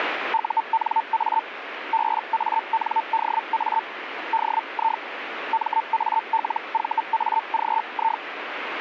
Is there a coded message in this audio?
Yes: Hellschreiber (Feld-Hell, 122.5 baud) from 0.3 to 8.2 s, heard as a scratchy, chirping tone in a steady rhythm, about 900 Hz, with radio static. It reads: UNA BANDA DI MALVAGI